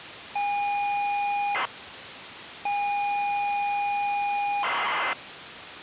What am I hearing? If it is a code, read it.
ZX Spectrum tape loading, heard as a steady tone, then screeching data, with tape hiss.